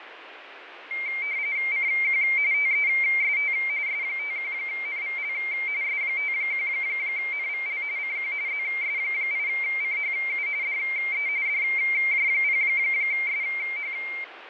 RTTY (45.45 baud, 170 Hz shift), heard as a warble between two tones, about 2200 Hz centre, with radio static and fading. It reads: CQ TEST S51NVL S51NVL CQ ZS8CHU DE DJ0SH